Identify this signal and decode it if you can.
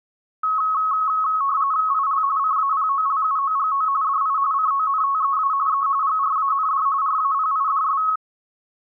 RTTY (45.45 baud, 170 Hz shift), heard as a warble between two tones, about 1190 Hz centre. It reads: IL CAPOLUOGO DI CONTEA E GRAND RAPIDS